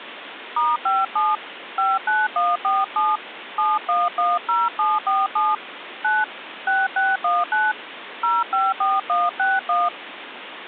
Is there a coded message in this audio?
Yes: DTMF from 0.6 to 9.9 s, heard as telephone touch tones, dialled by hand, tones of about 200 ms, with phone line noise. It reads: *57 59147 7110747 9 6619 054161